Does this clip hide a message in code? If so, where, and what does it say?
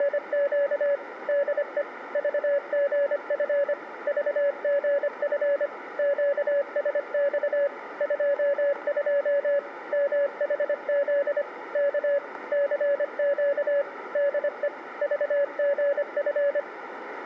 Yes: Morse code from 0.0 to 16.7 s, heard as a keyed tone, machine-sent, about 25 wpm, 560 Hz, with radio static and room echo. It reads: … DE VGF VGF QSX 22 MHZ K CQ DE VGF